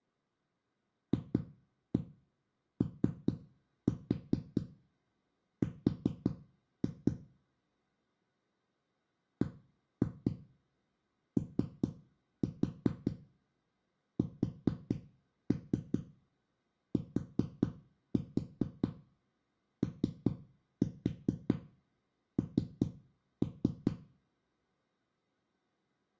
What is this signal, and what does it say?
Tap code, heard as knocks on a wall, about 4 knocks a second, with room echo. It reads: FOR BOSTON